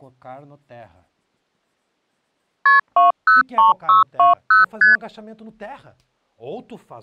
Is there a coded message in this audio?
Yes: multi-frequency trunk signalling (R1, as on North American trunks) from 2.7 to 5.0 s, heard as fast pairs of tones, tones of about 140 ms, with speech in Portuguese. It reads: KP 203620 ST